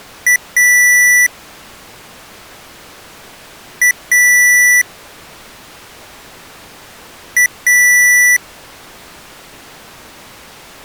Beep code, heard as beeps from a small speaker, played three times, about 1950 Hz. 1 short, 1 long.